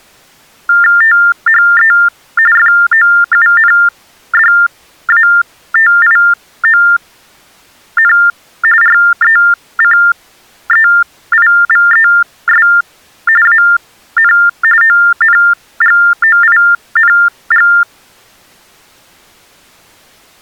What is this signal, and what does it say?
TTY/TDD text telephone tones (45.45 baud Baudot), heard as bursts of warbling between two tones, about 400 Hz shift, 1600 Hz centre. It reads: THE FOUNDATION RECEIVES AN ONGOING